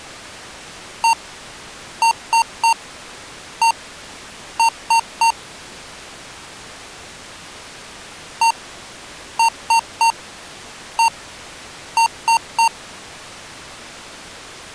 Beep code, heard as beeps from a small speaker, played twice, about 920 Hz. 1-3-1-3. In Phoenix BIOS tables: keyboard controller test failure.